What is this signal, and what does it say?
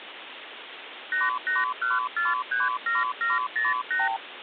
Multi-frequency trunk signalling (R2, with the far end's replies), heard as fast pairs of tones, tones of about 170 ms, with phone line noise. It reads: 881437708